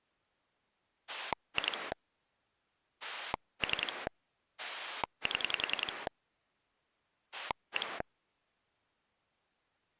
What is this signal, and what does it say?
Pulse dialling, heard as a rotary dial, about 10 pulses a second. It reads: 2 3 7 1